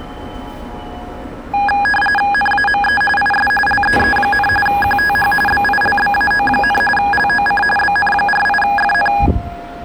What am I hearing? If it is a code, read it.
RTTY (45.45 baud, 850 Hz shift), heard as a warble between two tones, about 1240 Hz centre, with the noise of a subway station. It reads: NAME IS LEE, QTH BILBAO, LOC BN48FN